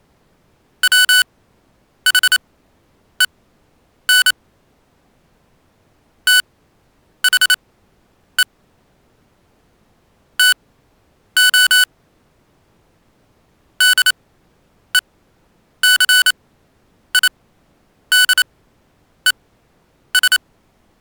Morse code, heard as electronic beeps, machine-sent, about 28 wpm, spaced as for 9 wpm, 1490 Hz. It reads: WHEN THE TO DECIDES